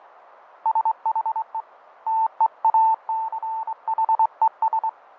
Morse code, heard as a keyed tone, hand-sent with a straight key, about 24 wpm, 890 Hz, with radio static and fading. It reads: SHE TEACHES